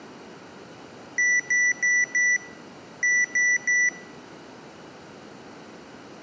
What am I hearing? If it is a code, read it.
Beep code, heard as beeps from a small speaker, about 1950 Hz. 4-3.